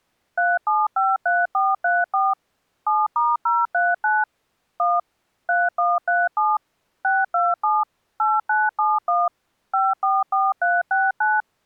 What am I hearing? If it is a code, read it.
DTMF, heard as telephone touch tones, dialled by machine, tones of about 200 ms. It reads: 3753434 7*039 1 3137 627 8971 544369